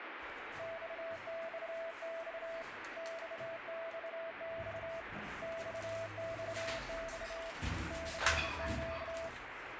Morse code, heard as a keyed tone, hand-sent with a straight key, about 27 wpm, 660 Hz, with radio static and the noise inside a lift. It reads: XXX XXX XXX CQ